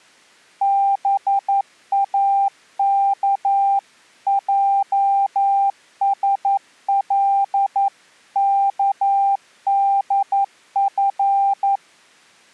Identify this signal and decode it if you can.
Morse code (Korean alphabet), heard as a keyed tone, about 11 wpm, 790 Hz. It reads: 동혁은